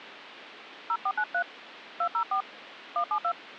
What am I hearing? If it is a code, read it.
DTMF, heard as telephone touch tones, dialled by hand, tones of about 80 ms. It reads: 0493 204 172